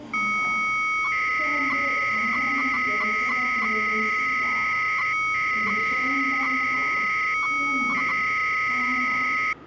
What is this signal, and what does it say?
300-baud modem data (Bell 103 tones), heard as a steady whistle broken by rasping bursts, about 300 baud, 200 Hz shift, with the noise of a subway station.